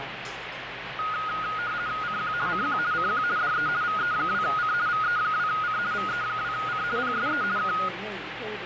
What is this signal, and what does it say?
RTTY (50 baud, 170 Hz shift), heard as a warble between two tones, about 1350 Hz centre, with radio static and the noise of a crowd indoors. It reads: CQ CQ CQ DE VE2C VE2C VE2C PSE K